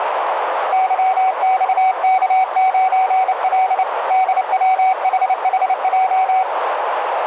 Morse code, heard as a keyed tone, hand-sent with a paddle, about 29 wpm, 750 Hz, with radio static and a narrow filter. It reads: YXK9L DWHHJ